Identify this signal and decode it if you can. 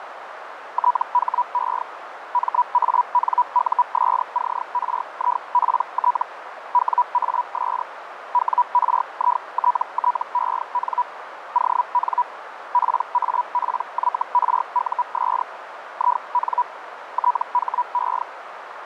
Hellschreiber (Feld-Hell, 122.5 baud), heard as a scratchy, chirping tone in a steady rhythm, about 980 Hz, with radio static and a narrow filter. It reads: THE MANUSCRIPT WAS WRITTEN ON PAPYRUS IN THE